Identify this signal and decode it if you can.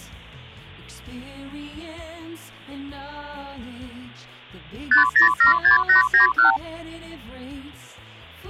Multi-frequency trunk signalling (R2, with the far end's replies), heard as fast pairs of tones, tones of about 120 ms. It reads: 5076891